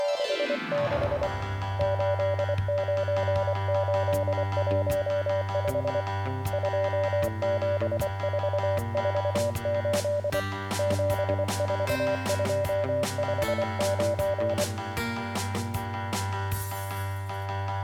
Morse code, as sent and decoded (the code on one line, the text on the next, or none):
… / ---.. ----. ---.. .---- ..... / ..--- --... ....- ....- ---.. / --... ....- ..--- ..... ----.
… 89815 27448 74259